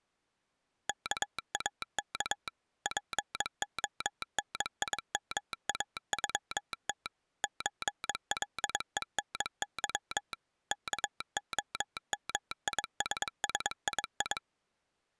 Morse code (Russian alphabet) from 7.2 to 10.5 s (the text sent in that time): ЧЛЕНЫ